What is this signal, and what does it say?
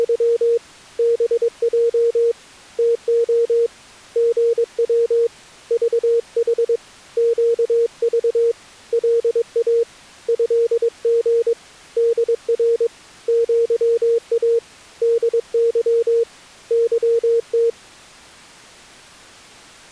Morse code (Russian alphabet), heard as a keyed tone, hand-sent with a paddle, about 22 wpm, 460 Hz. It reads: … БЙ ТО ГВ ЖХ ЩЖ ЛА ЭГ ДР ЪА ДЫ ЫТ